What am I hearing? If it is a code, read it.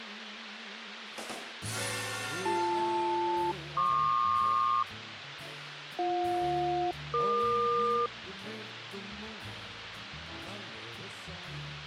Aircraft SELCAL, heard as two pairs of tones, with radio hiss. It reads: BL-PQ BJ-EQ